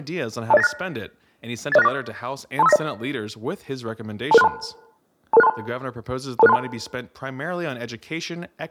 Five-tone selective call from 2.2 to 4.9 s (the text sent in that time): 23590 22632